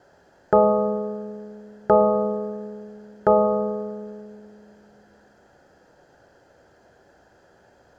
Clock strike, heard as a bell, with room echo. 3. Three o'clock.